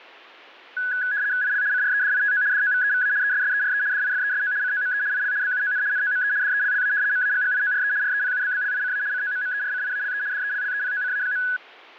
RTTY (75 baud, 170 Hz shift), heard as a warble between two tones, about 1600 Hz centre. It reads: IL CREDITO DOVEVA ESSERE DIFESO COME IL BUON NOME DELLA MAGGIORE REPUBBLICA COMMERCIALE DELLEPOCA.